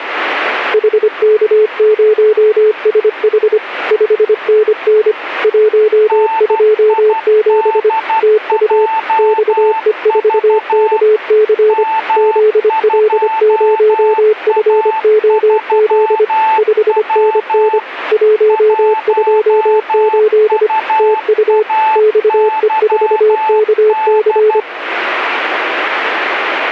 Morse code, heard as two keyed tones. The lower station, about 25 wpm, 430 Hz: HK0SH 5NN 127 TU XE4KC ZL0FOZ 5NN 128 TU XE4KC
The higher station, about 12 wpm, 880 Hz: NIDJV M2A3W 1UAYD